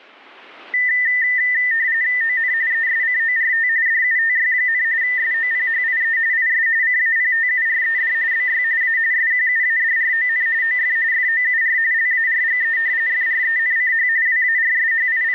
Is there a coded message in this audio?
Yes: RTTY (45.45 baud, 170 Hz shift) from 0.7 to 15.3 s, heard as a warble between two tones, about 1900 Hz centre. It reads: ON ESCORT DUTY, SOPHIE IS CAPTURED BY A SQUADRON OF FOUR LARGE FRENCH …